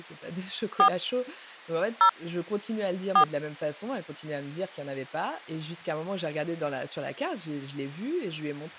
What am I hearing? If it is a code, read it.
DTMF, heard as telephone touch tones, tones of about 80 ms, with speech in French. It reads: 4 0 4